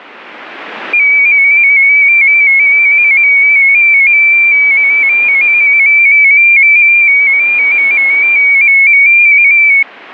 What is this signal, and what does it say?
Multi-tone FSK (Olivia or MFSK type), about 250 Hz wide, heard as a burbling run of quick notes, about 15.625 baud.